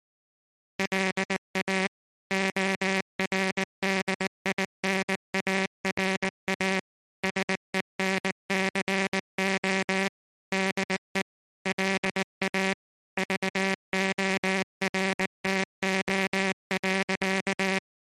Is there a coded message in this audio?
Yes: Morse code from 0.7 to 17.8 s, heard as a buzzer, machine-sent, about 19 wpm. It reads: LA ORDINARA SENCO DE LA VORTO.